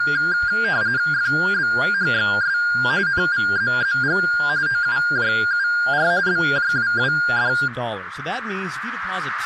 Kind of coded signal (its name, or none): RTTY